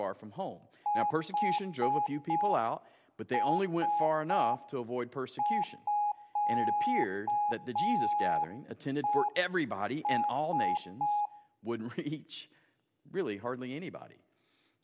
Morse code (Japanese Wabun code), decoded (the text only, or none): ヌラミヘラ